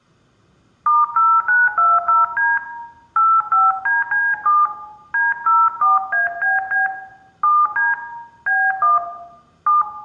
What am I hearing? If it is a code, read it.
DTMF, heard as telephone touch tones, dialled by hand, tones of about 180 ms, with room echo. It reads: *0920D 85DC7 D04ABB 7D B1 7